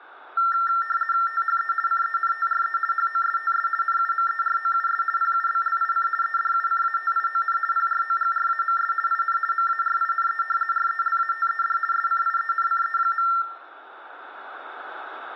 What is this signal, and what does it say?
RTTY (50 baud, 450 Hz shift), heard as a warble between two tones, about 1600 Hz centre, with room echo. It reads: THE CENTRE HOSTS NUMEROUS PUBLIC EDUCATION PROGRAMS IN MARINE RELATED SCIENCE.